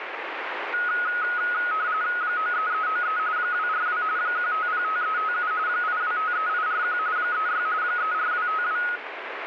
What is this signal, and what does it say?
RTTY (45.45 baud, 170 Hz shift), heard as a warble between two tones, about 1360 Hz centre, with radio static. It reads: 93393 242 1505357 8253841 36 34252